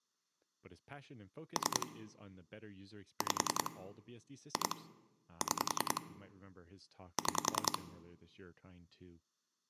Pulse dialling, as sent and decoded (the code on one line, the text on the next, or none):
3 / 5 / 2 / 6 / 6
3 5 2 6 6